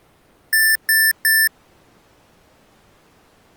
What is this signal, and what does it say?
Beep code, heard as beeps from a small speaker, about 1750 Hz. 3 short. In AMI BIOS tables: failure in the first 64 KB of memory; in Dell tables: chipset error.